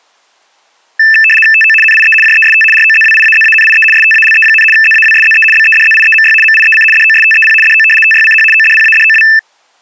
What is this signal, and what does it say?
RTTY (75 baud, 850 Hz shift), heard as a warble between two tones, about 2200 Hz centre. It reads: TO NIE JEST ROZWIAZANIE STALE, ZAWSZE BEDZIEMY MIEC DOSTEP DO TYCH ODPADOW